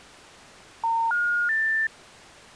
Telephone call progress tone (North American plan), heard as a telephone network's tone, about 910, 1430, 1800 Hz. Special information tone.